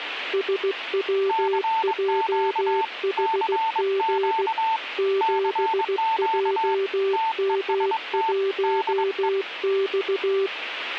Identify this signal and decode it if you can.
Morse code, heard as two keyed tones, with radio static. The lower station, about 16 wpm, 390 Hz: SWJHG 7JM1X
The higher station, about 22 wpm, 890 Hz: CQ CQ CQ TEST DE